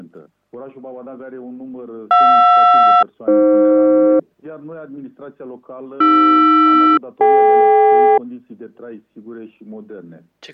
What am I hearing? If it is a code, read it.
Aircraft SELCAL, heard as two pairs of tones. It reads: JR-AF AR-DK